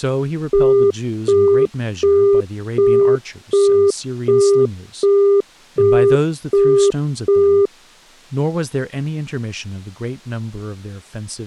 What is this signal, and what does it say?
Telephone call progress tone (as in the UK, Australia and similar networks), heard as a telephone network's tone, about 400 Hz, 0.375 s on and 0.375 s off, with speech in English. Busy tone.